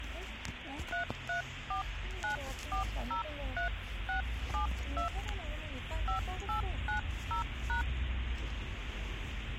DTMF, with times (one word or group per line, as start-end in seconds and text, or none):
0.9-5.1 3349403672
6.1-7.8 5890#